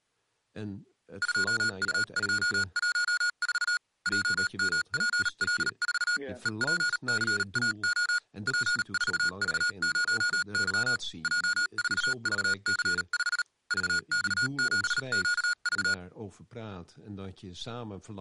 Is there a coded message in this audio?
Yes: Morse code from 1.2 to 16.0 s, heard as electronic beeps, machine-sent, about 38 wpm, spaced as for 34 wpm, 1440 Hz, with speech in Dutch. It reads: 2U214 JMPL4 EPCAO P4V0Y J4VC5 VX7QV